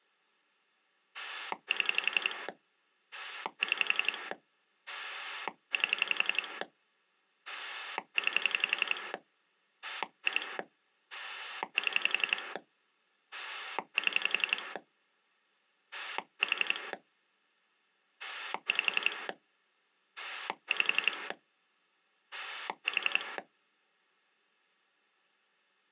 Pulse dialling, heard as a rotary dial, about 11 pulses a second. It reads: 7 6 8 9 2 7 7 4 5 5 4